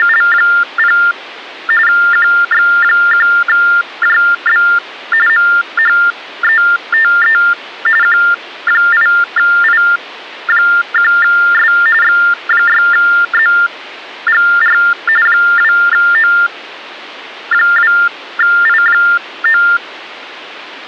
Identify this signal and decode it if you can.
TTY/TDD text telephone tones (45.45 baud Baudot), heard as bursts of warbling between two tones, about 400 Hz shift, 1600 Hz centre. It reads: … QX1JB MHETE Q8I1S X6ZGR 2O2I9